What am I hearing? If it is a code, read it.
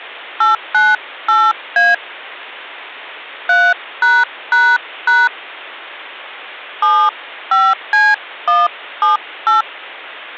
DTMF, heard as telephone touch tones, dialled by hand, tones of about 220 ms. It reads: 898A 3### 75C178